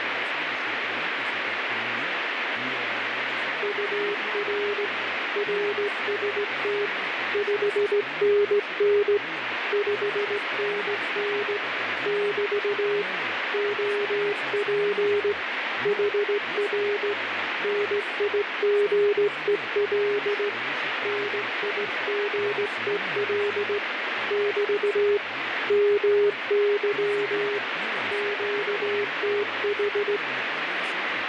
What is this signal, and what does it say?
Morse code, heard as a keyed tone, hand-sent with a straight key, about 17 wpm, 410 Hz, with radio static and speech in Russian. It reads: UR RST 5NN 5NN <BT> OP HR NIGEL NIGEL <BT> MY QTH